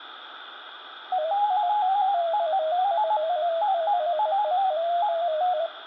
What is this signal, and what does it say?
Multi-tone FSK (Olivia or MFSK type), about 250 Hz wide, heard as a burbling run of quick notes, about 15.625 baud, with radio static and room echo.